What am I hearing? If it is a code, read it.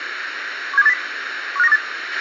Five-tone selective call (EEA), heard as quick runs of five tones, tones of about 40 ms, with radio hiss and a squelch burst at the end. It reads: 17280 15928